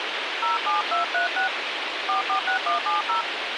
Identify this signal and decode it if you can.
DTMF, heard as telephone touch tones, dialled by hand, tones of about 120 ms, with radio hiss. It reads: 07236 446170